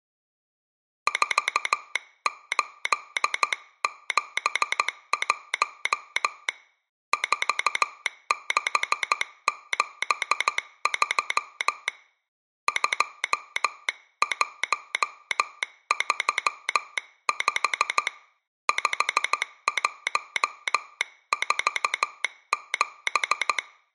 Morse code, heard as a telegraph sounder, hand-sent with a straight key, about 14 wpm. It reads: 4871 4673 2135 5147